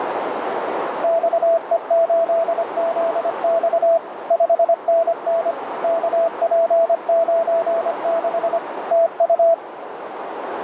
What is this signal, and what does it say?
Morse code, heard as a keyed tone, machine-sent, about 25 wpm, 660 Hz, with radio static and a narrow filter. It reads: XE8ZX 5NN KP96 TU